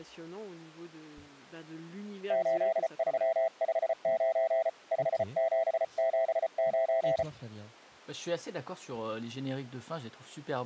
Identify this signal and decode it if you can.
Morse code, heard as a keyed tone, hand-sent with a paddle, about 34 wpm, 660 Hz, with speech in French. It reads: 8359 5779